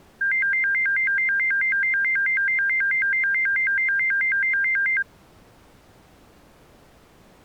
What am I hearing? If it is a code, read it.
A tone that alternates evenly between two pitches. There is no code.